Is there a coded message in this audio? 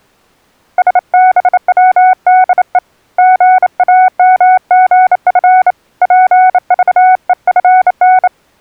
Yes: Morse code (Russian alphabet) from 0.7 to 8.3 s, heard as a keyed tone, hand-sent with a bug key, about 28 wpm, 740 Hz. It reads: СБВДЕ ГАМГФ ПЖЕФН